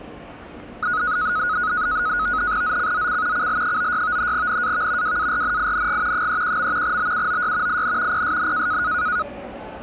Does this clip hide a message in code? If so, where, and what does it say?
Yes: NAVTEX (SITOR-B), 100 baud, 170 Hz shift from 0.8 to 9.2 s, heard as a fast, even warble, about 1360 Hz centre, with the noise of a subway station. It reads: ZCZC CL96 NAV WARNING 31. BUOY IN PSN